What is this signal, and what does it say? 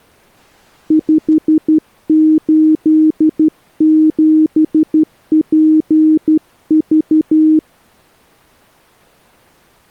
Morse code, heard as a keyed tone, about 12 wpm, 310 Hz. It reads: 587PV